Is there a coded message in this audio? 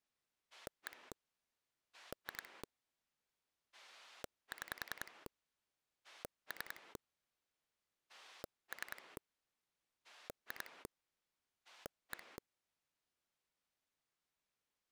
Yes: pulse dialling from 0.5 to 12.4 s, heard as a rotary dial, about 10 pulses a second. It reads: 1 2 6 3 3 2 1